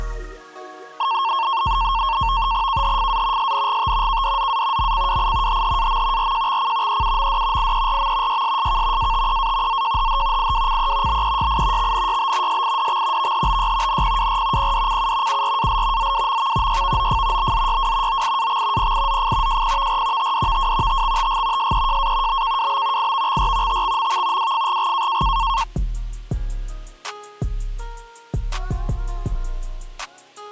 NAVTEX (SITOR-B), 100 baud, 170 Hz shift, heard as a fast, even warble, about 1000 Hz centre. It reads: KHFA SNGT KDZA MCWI HHAM RJXC EUMD IERM YSSK ATEA ZJHH IWCE BEYI XNYB SIDX VHBY NPWR PDCU URAL ZWMV YVOF BZYW OIAX PIZF JPVR TDVW TXTG SEJA BKWB IVXR TXMV WFGG